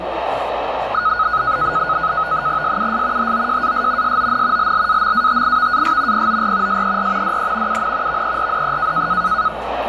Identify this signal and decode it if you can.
NAVTEX (SITOR-B), 100 baud, 170 Hz shift, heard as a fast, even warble, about 1360 Hz centre, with radio static and the noise of a restaurant. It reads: SUS HOJAS SON LLAMATIVAS POR SER DE UN VERDE